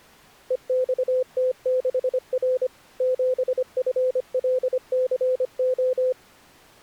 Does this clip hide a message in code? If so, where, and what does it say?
Yes: Morse code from 0.4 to 6.2 s, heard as a keyed tone, machine-sent, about 25 wpm, 510 Hz. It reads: EXT6R 7FLCO